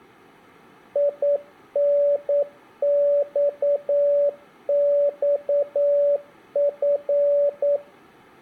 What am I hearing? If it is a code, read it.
Morse code (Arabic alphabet), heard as a keyed tone, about 9 wpm, 570 Hz, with room echo. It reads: ينصصف